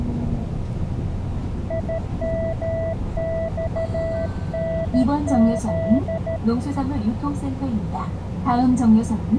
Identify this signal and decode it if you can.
Morse code, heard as a keyed tone, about 13 wpm, 660 Hz, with the noise inside a bus. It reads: IMXNZ